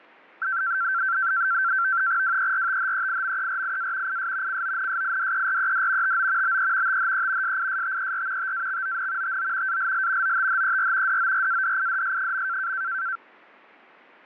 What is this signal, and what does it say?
NAVTEX (SITOR-B), 100 baud, 170 Hz shift, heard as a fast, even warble, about 1460 Hz centre. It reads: WERTHEIMERIA IS CONSIDERED TO BE THE SISTER TAXON TO ALL OTHER DORADIDS.